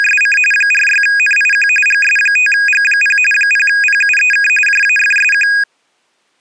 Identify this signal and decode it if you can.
RTTY (45.45 baud, 850 Hz shift), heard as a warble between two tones, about 2050 Hz centre. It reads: … 46NIQ GS5G0 0PUEK JAFSQ